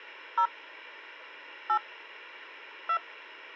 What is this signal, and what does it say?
DTMF, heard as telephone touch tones, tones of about 80 ms. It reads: 0 8 2